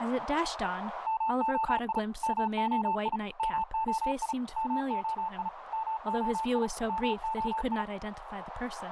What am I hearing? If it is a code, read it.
Morse code, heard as a keyed tone, machine-sent, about 35 wpm, 890 Hz, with radio static, a narrow filter and speech in English. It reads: MOI MOI MOI MOI MOI MOI